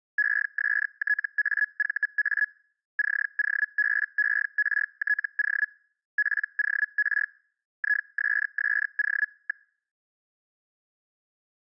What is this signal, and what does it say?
Hellschreiber (Feld-Hell, 122.5 baud), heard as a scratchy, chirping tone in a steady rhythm, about 1700 Hz. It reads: ESTAVA COBERTO POR ISSO.